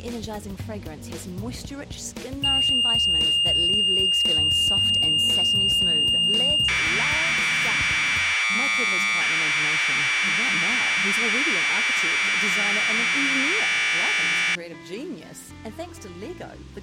Commodore tape loading (standard loader), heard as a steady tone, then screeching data.